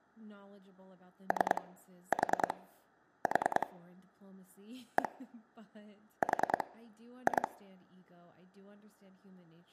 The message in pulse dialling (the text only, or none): 3 4 4 1 4 2